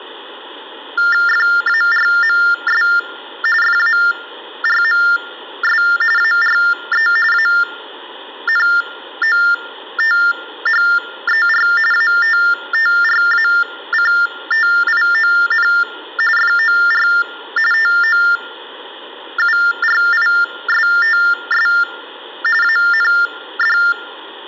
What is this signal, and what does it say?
TTY/TDD text telephone tones (45.45 baud Baudot), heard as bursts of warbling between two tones, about 400 Hz shift, 1600 Hz centre. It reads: FARMS FARMS ARE ANOTHER ATTRACTION FOR TOURISTS AND